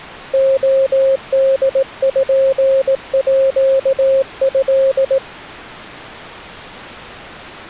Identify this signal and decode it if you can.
Morse code (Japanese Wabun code), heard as a keyed tone, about 18 wpm, 540 Hz. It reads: レポート